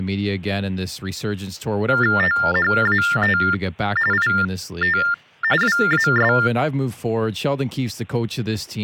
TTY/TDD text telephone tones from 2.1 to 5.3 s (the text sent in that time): THAT IT